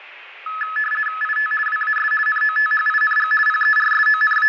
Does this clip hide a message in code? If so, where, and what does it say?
Yes: RTTY (50 baud, 450 Hz shift) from 0.5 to 4.5 s, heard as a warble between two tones, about 1500 Hz centre, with room echo. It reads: IT WAS NOTHING …